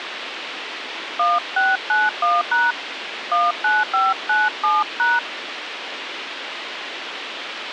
DTMF, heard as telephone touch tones, dialled by hand, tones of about 190 ms, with radio hiss. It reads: 1691# 19597#